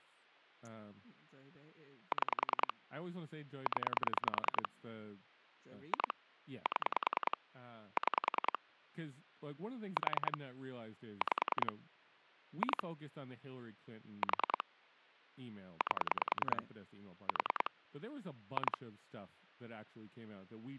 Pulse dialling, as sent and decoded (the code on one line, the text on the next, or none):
6 / 10 / 2 / 7 / 6 / 4 / 5 / 2 / 4 / 8 / 4 / 2
6 0 2 7 6 4 5 2 4 8 4 2